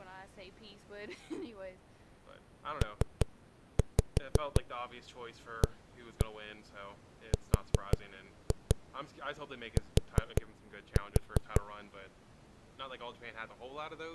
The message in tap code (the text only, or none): PART